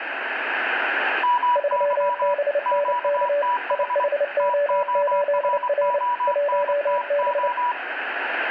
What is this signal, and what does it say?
Morse code, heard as two keyed tones, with radio static and room echo. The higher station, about 24 wpm, 980 Hz: MY QTH TORONTO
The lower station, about 29 wpm, 580 Hz: 3BNK IHO8R 1B